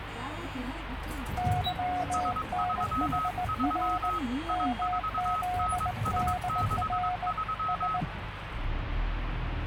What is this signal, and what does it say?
Morse code, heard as two keyed tones, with radio static and the noise inside a bus. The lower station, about 19 wpm, 720 Hz: YNHR MZDR S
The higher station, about 22 wpm, 1280 Hz: S33 I4NS63